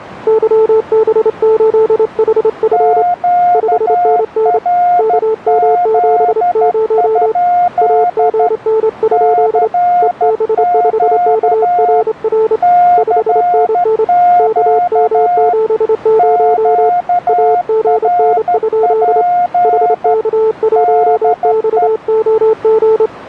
Morse code, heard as two keyed tones. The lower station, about 27 wpm, 440 Hz: YB8HF 5NN KM70 AGN? EB5KRR 5NN KM70 AGN? HK1XOG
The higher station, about 13 wpm, 710 Hz: QRZ? CQ CQ QRP DE